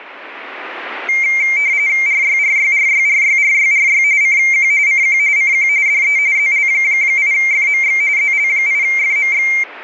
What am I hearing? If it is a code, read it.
RTTY (45.45 baud, 170 Hz shift), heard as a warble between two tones, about 2200 Hz centre. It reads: RYRYRYRYRYRY CQ CQ CQ DE ZL8FMX ZL8FMX